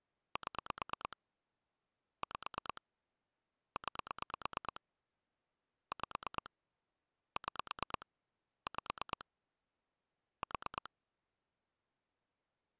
Pulse dialling, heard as clicks on a phone line, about 9 pulses a second. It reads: 7 5 9 5 6 5 4